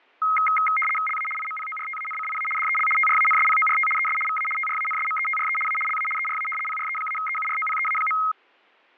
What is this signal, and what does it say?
RTTY (75 baud, 850 Hz shift), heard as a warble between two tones, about 1700 Hz centre, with fading. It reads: LA IMPORTANCIA DEL TRANSPORT ES VA TRANSMETRE A LA ERA PRE-EUROPEA.